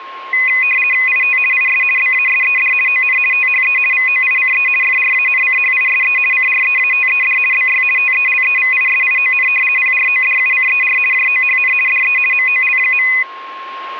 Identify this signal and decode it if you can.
RTTY (50 baud, 450 Hz shift), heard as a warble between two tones, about 2250 Hz centre, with a steady whistle near 1070 Hz. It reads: IT IS BASED ON THE VOICE FRANCHISE CREATED BY TELEVISION PRODUCER JOHN DE MOL.